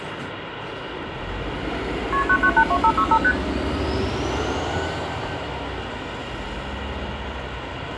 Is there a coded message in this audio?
Yes: multi-frequency trunk signalling (R1, as on North American trunks) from 2.1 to 3.3 s, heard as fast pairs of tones, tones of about 70 ms, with phone line noise, room echo and street noise. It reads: KP 9982565 ST